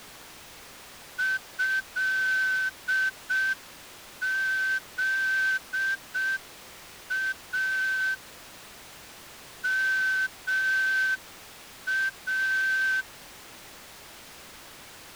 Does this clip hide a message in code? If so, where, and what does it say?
Yes: Morse code (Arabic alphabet) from 1.1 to 13.1 s, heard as a whistle, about 6 wpm. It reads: هذا ما